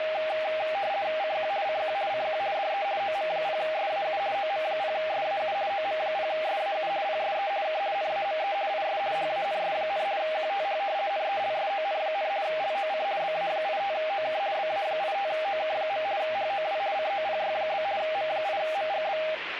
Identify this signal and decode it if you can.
RTTY (50 baud, 170 Hz shift), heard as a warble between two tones, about 710 Hz centre, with radio static and speech in English. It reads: CQ CQ CQ DE OM0SAU OM0SAU OM0SAU PSE K NAME IS HANS, QTH NELSON, LOC BA85OK BA85OK. HOW COPY? M8MGB